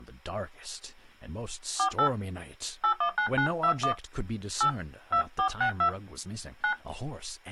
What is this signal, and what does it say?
DTMF, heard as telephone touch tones, dialled by hand, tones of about 90 ms, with speech in English. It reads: 48 819921 8 2462 9